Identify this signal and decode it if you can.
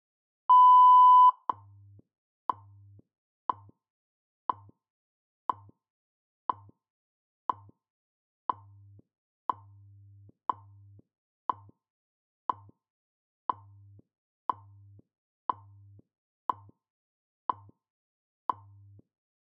Radio time signal (WWV, Colorado), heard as ticks, one a second.